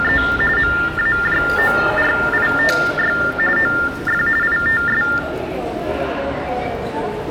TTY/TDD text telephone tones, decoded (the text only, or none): … MAJORITY OF ITS